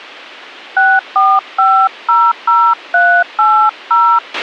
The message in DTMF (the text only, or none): 64500380